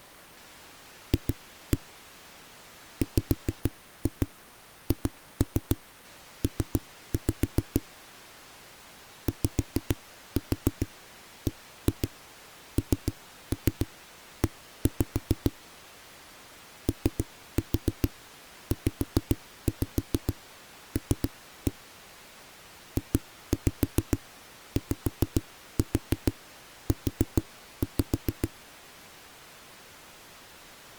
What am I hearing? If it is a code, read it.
Tap code, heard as knocks on a wall, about 6 knocks a second. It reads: F WHP YBNE OZL JYU